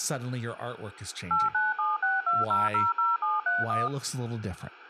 DTMF, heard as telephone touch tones, dialled by machine, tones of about 180 ms. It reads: 89762000731